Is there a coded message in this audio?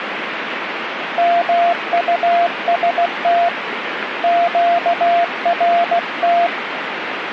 Yes: Morse code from 1.1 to 6.5 s, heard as a keyed tone, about 16 wpm, 690 Hz, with radio static. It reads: MUST QRT